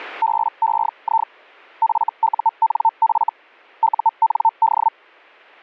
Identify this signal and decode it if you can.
Hellschreiber (Feld-Hell, 122.5 baud), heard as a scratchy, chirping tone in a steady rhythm, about 900 Hz. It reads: BEI FUNF UND